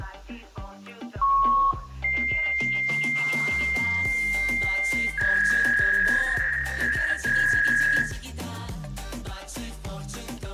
Fax machine handshake, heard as a beep, a long tone and a warble, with room echo.